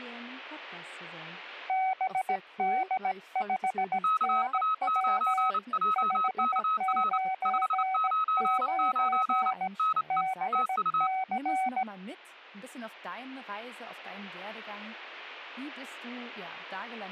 Morse code, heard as two keyed tones. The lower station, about 17 wpm, 760 Hz: BD5NW 599 BC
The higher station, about 29 wpm, 1280 Hz: KA9JKR 599 NE TU